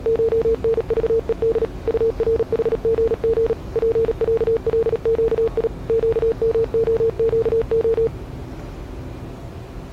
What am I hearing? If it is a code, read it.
Morse code (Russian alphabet), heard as a keyed tone, machine-sent, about 37 wpm, 450 Hz, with the noise of a subway station. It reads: ШНЖЕД УРХГГ ПЯЛЩИ ЩМОЩО